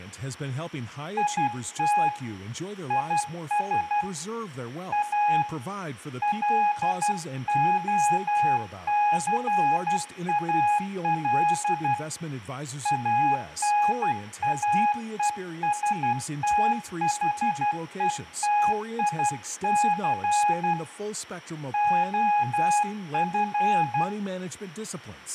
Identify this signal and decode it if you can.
Morse code, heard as a keyed tone, hand-sent with a paddle, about 12 wpm, 830 Hz, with room echo and speech in English. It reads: IT IS A LOCAL ANAESTHETIC OF